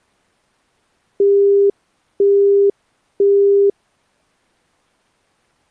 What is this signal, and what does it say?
Telephone call progress tone (single-tone plan, as in Europe, Japan and elsewhere), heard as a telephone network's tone, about 400 Hz, 0.5 s on and 0.5 s off. Busy tone.